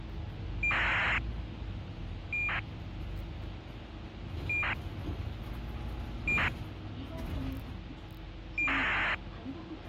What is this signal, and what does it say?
ACARS aircraft data, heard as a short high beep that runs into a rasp, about 2400 baud, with the noise inside a bus.